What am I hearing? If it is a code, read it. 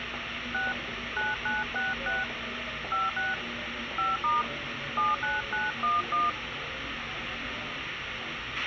DTMF, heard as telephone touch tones, dialled by hand, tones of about 180 ms, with radio hiss, a squelch burst at the end and the noise of a subway station. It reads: 6 9966 56 5* 79911